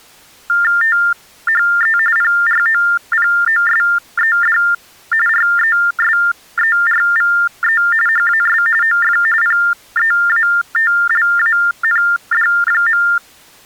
TTY/TDD text telephone tones (45.45 baud Baudot), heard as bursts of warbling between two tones, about 400 Hz shift, 1600 Hz centre. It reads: THE PROPOSED RESERVE HAS OF PEATLAND.